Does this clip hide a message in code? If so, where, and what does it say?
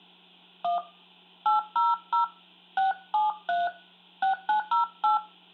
Yes: DTMF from 0.6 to 5.2 s, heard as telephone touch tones, dialled by hand, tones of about 140 ms, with hum and room echo. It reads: 1 800 673 6908